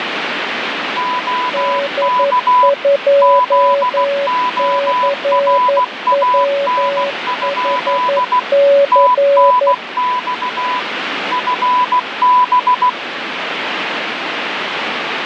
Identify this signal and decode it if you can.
Morse code, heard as two keyed tones, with radio static. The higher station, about 16 wpm, 1000 Hz: OK ZORAN? TNX FB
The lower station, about 11 wpm, 560 Hz: D2CWHC